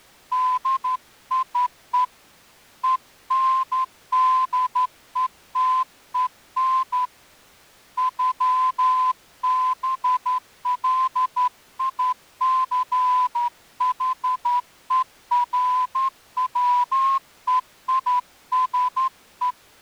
Morse code (with German letters), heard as a whistle, hand-sent with a straight key, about 12 wpm. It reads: DIE ENDETEN ÜBLICHERWEISE